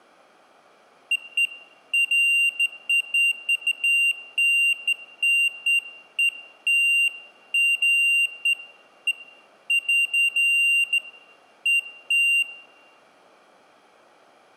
Beeps of irregular length, with room echo. There is no code.